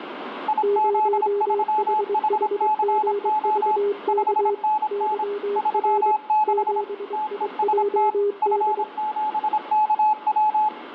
Morse code, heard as two keyed tones, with radio static. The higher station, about 26 wpm, 860 Hz: IZ3HCO 5NN 36 TEST F7KW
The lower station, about 23 wpm, 410 Hz: 0HHGVK YR 7IJD